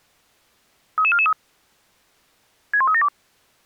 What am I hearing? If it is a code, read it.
Five-tone selective call (ZVEI), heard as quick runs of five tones, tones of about 70 ms. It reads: 33443 61372